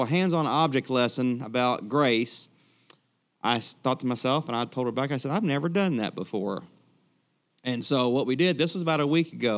Speech in English. There is no code.